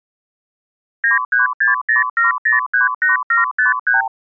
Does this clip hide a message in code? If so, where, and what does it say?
Yes: multi-frequency trunk signalling (R2, with the far end's replies) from 1.0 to 4.1 s, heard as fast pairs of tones, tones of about 140 ms. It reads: 93607038753